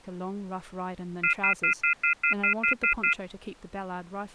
Telephone call progress tone (North American plan), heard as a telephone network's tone, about 1400, 2050, 2450, 2600 Hz, 0.1 s on and 0.1 s off, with speech in English. Off-hook warning tone.